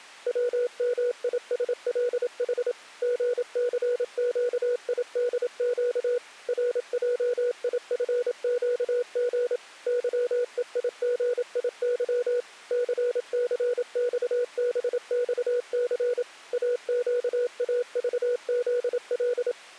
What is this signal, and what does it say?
Morse code, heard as a keyed tone, machine-sent, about 27 wpm, 490 Hz. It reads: WMISLH GCQIDQ RJIFQG YEIGIY CCXBXC AQAVZL